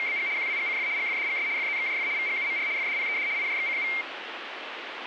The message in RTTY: … QWGCF GFDGS FZXJF VGUMR FDPED IJXCU

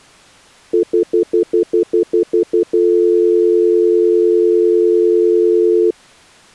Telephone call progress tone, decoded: stutter dial tone

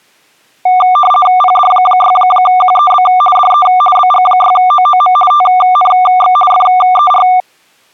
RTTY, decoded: PD6QEB DE BG6OOM TNX FER

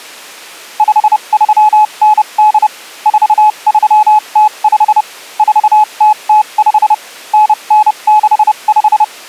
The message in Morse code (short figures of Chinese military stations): 5398 4305 4005 9965

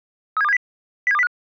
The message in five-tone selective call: 37270 07205

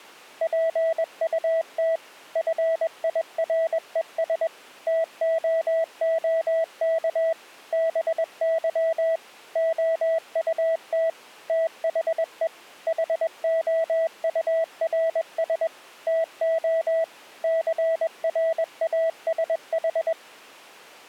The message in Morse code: PUT FIRES TOOK BY OUT THE HOURS TO CRASH

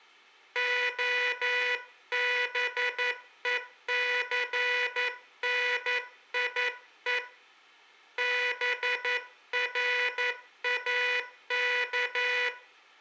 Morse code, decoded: OBECNIE BRAK

